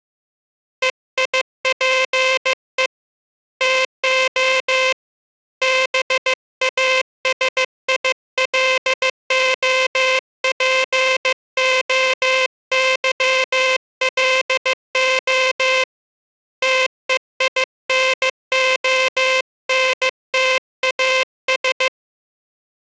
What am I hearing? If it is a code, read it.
Morse code (Greek alphabet), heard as a buzzer, hand-sent with a paddle, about 15 wpm. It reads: ΕΙΠΕ ΤΟ ΒΑΣΙΛΟΠΟΥΛΟ ΤΕΙΝΟΝΤΑΣ